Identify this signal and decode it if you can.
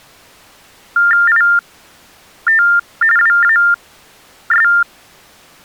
TTY/TDD text telephone tones (45.45 baud Baudot), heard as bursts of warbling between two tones, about 400 Hz shift, 1600 Hz centre. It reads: IT WAS